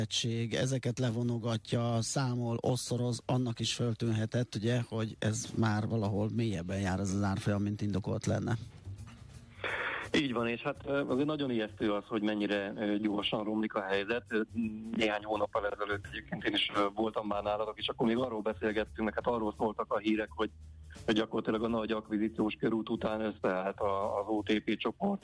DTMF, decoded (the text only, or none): none